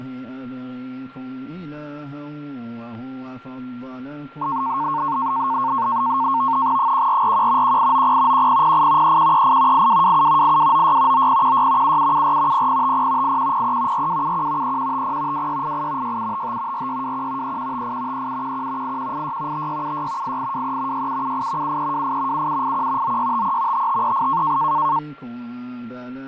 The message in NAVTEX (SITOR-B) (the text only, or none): 1441 1890 1008 3138 8227 8296 9016 7774 0050 8103 4271 3150 2688 6755 4621 3158 3711 8186 5676 8823 6778 7328 7781 9653 5538